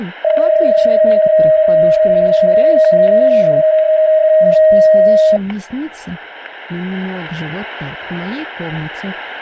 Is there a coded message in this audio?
Yes: PSK31 (31.25 baud) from 0.2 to 5.4 s, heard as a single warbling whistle, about 630 Hz, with static crashes.